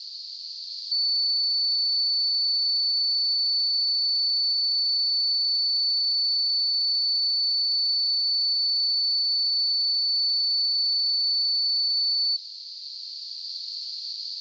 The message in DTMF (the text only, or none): none